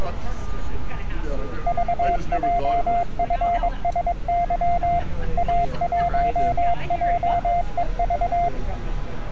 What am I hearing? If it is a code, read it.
Morse code, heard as a keyed tone, machine-sent, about 22 wpm, 700 Hz, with street noise. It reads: VJFSY A1JEV